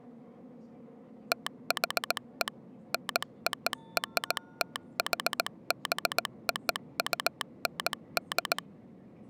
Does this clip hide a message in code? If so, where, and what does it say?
Yes: Morse code (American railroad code) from 1.3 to 8.6 s, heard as a telegraph sounder, machine-sent, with the noise inside a subway train. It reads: THE NORTHBOUND